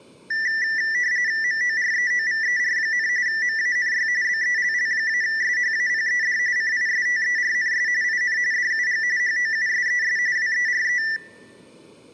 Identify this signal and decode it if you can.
RTTY (45.45 baud, 170 Hz shift), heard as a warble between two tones, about 1850 Hz centre, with room echo. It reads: MOREOVER, MANY BELL-SHAPED CISTERNS IN DUG HOUSES WERE